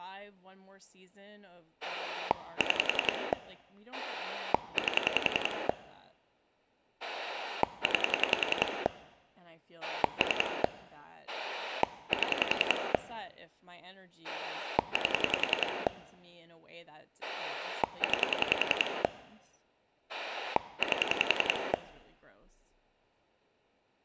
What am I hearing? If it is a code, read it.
Pulse dialling, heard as a rotary dial, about 10 pulses a second, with speech in English. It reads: 6 8 9 3 7 8 9 8